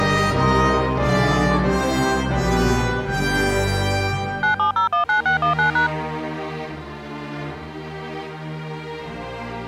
DTMF, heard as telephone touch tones, dialled by machine, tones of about 120 ms. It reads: 97019619#